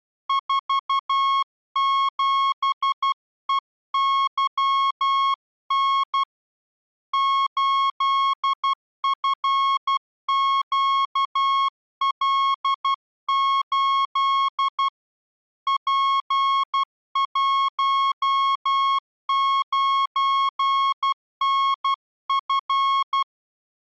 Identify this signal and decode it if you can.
Morse code, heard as a keyed tone, hand-sent with a paddle, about 12 wpm, 1090 Hz. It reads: 47EYN 8FQL8 P19NF